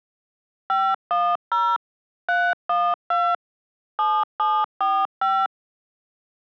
DTMF, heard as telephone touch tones, dialled by machine, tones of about 250 ms. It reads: 510 312 7745